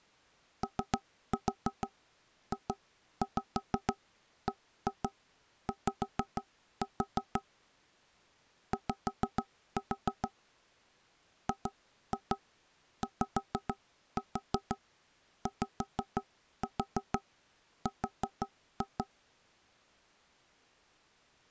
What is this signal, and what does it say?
Tap code, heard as knocks on wood, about 6 knocks a second. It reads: OJBY Y GYYR